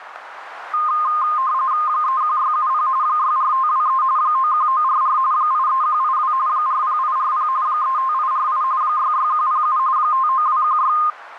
RTTY (45.45 baud, 170 Hz shift), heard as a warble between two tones, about 1140 Hz centre, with radio static. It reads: 31670 64523 91944 83182 40840 35848 66107 59216